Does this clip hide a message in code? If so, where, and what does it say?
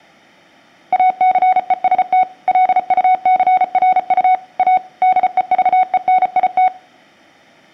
Yes: Morse code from 0.9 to 6.7 s, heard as a keyed tone, machine-sent, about 34 wpm, 740 Hz, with room echo. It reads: ACEST LUCRU A DEVENIT